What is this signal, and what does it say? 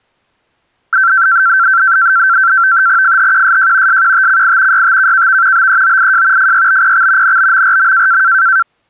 NAVTEX (SITOR-B), 100 baud, 170 Hz shift, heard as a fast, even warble, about 1460 Hz centre. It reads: FHQSJ SQTCI YTKKV BEOIJ FYBPX NBMRM